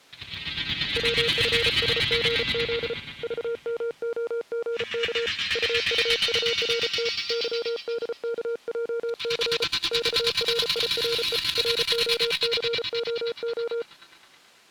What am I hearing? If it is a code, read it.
Morse code, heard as a keyed tone, hand-sent with a paddle, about 34 wpm, 470 Hz. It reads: WFSGZ VMOGK UUURT YDKJC XRIRE ROCOO